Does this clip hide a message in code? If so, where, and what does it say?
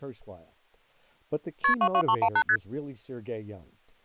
Yes: multi-frequency trunk signalling (R1, as on North American trunks) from 1.6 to 2.6 s, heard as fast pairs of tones, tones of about 70 ms. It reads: KP 22318 ST